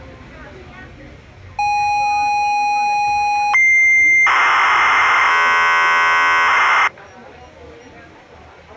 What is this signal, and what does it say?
ZX Spectrum tape loading, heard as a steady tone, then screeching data, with the noise of a crowd indoors.